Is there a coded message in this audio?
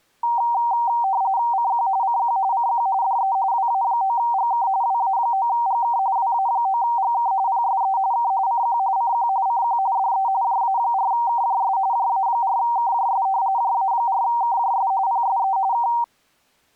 Yes: RTTY (45.45 baud, 170 Hz shift) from 0.2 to 16.0 s, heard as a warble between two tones, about 860 Hz centre. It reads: CQ CQ CQ DE WA9GK WA9GK WA9GK PSE K CQ CQ CQ DE JA4KJS JA4KJS JA4KJS PSE K